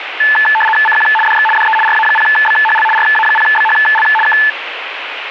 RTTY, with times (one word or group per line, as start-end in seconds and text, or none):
0.9-1.1 CQ
1.3-1.5 DX
1.6-1.8 DE
1.9-2.9 RA0BHL
3.0-4.1 RA0BHL
4.3-4.4 K